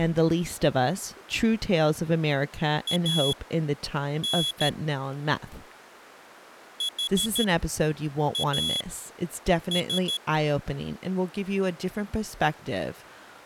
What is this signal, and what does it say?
Morse code, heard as a high beeper, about 13 wpm, spaced as for 7 wpm, 3350 Hz, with speech in English. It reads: AN HAS